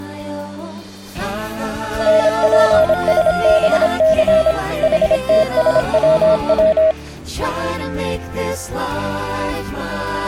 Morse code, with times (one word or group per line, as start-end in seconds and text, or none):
2.1-4.5 NPSBC
4.8-6.9 HTSWW